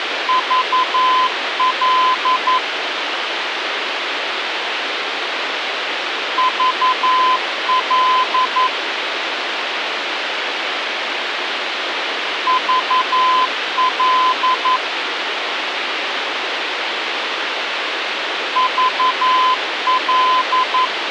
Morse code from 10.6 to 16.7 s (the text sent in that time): VL